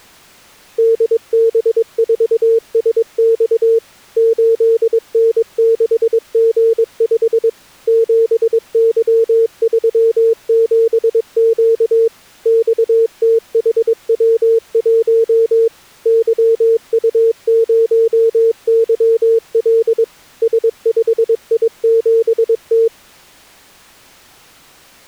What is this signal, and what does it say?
Morse code, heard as a keyed tone, machine-sent, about 22 wpm, 450 Hz. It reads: DB4SX 8N6G5 7Y37Q XTHW1 YU0YL S5I7T